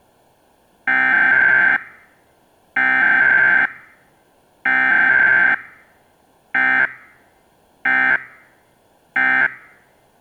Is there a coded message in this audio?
Yes: Emergency Alert System (SAME) tones (header bursts, then end-of-message bursts) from 0.9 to 9.5 s, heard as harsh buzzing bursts, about 520.83 baud.